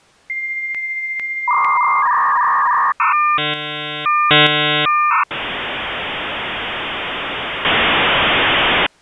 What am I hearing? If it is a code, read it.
Dial-up modem handshake (V.34 or later), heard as a whistle, warbles, then hiss.